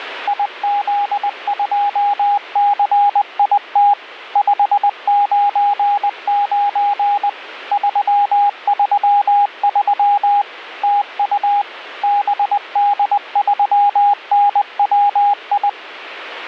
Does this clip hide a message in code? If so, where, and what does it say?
Yes: Morse code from 0.2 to 15.8 s, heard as a keyed tone, machine-sent, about 20 wpm, 820 Hz, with radio static. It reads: IZ2CIT 599 333 TU BD3NWI